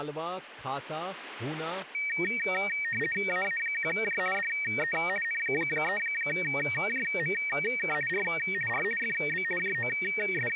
RTTY (50 baud, 450 Hz shift), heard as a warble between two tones, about 2050 Hz centre, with speech in Gujarati. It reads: AA1J DE N3JMK R R FB …